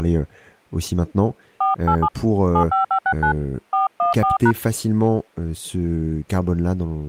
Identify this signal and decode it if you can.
DTMF, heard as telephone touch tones, dialled by hand, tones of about 100 ms, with speech in French. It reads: 487 75569 414#